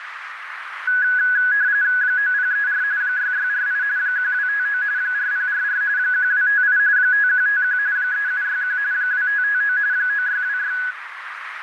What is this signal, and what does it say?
RTTY (45.45 baud, 170 Hz shift), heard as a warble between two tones, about 1600 Hz centre, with radio static and a narrow filter. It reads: 9034 6648 1259 4044 1258 5151 3761 2559 9626